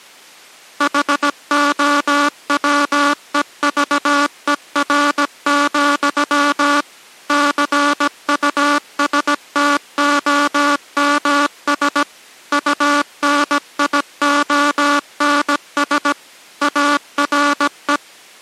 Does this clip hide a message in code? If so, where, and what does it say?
Yes: Morse code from 0.7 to 18.0 s, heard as a buzzer, machine-sent, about 17 wpm. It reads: HOWEVER, CUSTOMS UNIONS ARE